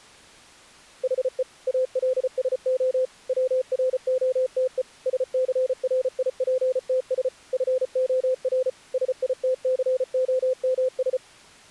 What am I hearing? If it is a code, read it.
Morse code, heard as a keyed tone, machine-sent, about 34 wpm, 520 Hz. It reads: HE ALSO WROTE SCRIPTS FOR SITCOMS